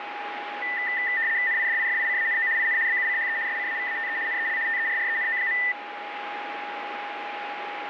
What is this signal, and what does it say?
RTTY (75 baud, 170 Hz shift), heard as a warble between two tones, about 1900 Hz centre, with radio static and a steady whistle near 820 Hz. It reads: NIDIFICANO IN BUCHE SCAVATE NEL TERRENO.